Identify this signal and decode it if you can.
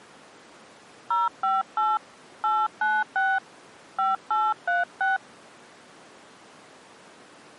DTMF, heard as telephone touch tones, dialled by hand, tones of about 190 ms. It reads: 058 896 5836